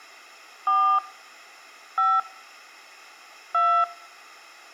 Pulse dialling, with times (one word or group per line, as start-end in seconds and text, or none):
none